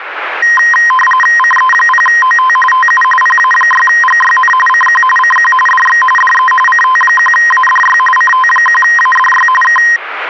RTTY (45.45 baud, 850 Hz shift), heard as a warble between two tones, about 1460 Hz centre, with radio static. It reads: CE0OT TU PA6GYN CQ CQ DX DE CT1ADY CT1ADY K